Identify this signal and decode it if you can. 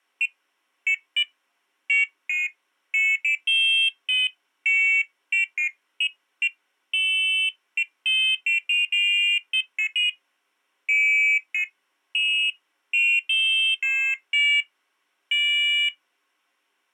Pairs of high tones at irregular times. There is no code.